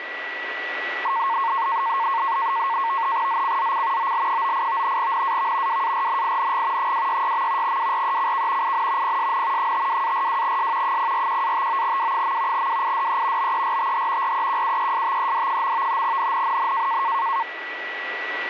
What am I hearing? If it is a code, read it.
NAVTEX (SITOR-B), 100 baud, 170 Hz shift, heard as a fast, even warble, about 1000 Hz centre, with radio static and a steady whistle near 1950 Hz. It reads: ZCZC OL98 NAV WARNING 266. WRECK IN PSN 52-42S 041-59W. WIDE BERTH REQUESTED. NNNN